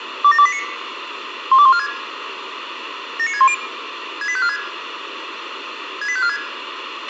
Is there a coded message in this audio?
Yes: five-tone selective call (ZVEI) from 0.2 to 6.4 s, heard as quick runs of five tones, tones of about 70 ms, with radio hiss, a squelch burst at the end and room echo. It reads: 27289 12146 79610 68546 68546